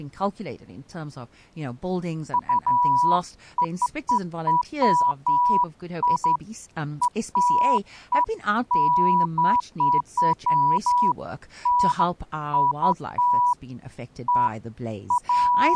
Beeps of irregular length, with speech in English. There is no code.